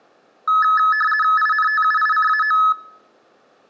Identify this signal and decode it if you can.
RTTY (50 baud, 450 Hz shift), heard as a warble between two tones, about 1500 Hz centre. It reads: INTUICAO